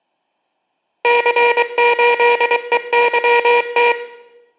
Morse code, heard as a buzzer, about 23 wpm. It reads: C8EYT